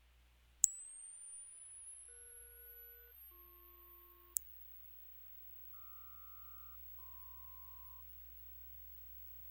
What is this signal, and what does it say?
Aircraft SELCAL, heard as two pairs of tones, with radio hiss. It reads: ES-BP QR-MP